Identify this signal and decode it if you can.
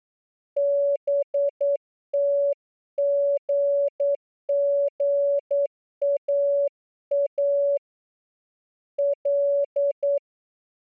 Morse code, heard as a keyed tone, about 9 wpm, 570 Hz. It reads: BTGGAA L